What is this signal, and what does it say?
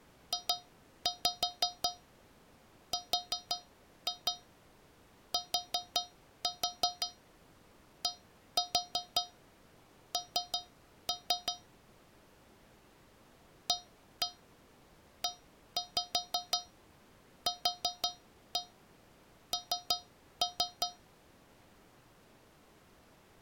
Tap code, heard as taps on a metal pipe, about 5 knocks a second. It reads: JRTDN AEQN